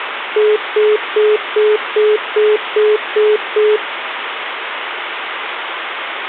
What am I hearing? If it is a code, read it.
Telephone call progress tone (single-tone plan, as in most of Europe), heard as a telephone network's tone, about 420 Hz, 0.2 s on and 0.2 s off, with phone line noise. Congestion tone.